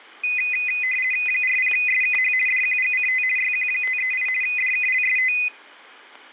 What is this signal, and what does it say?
RTTY (50 baud, 450 Hz shift), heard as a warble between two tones, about 2250 Hz centre, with static crashes. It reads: 40SKH DQGCT YQ538 DKLST